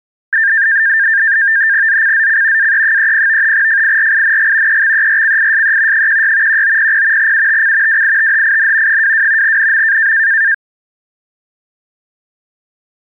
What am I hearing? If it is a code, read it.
NAVTEX (SITOR-B), 100 baud, 170 Hz shift, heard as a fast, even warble, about 1700 Hz centre. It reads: ZCZC AE30 FIRING EXERCISE 16 1900 UTC WITHIN 22 NM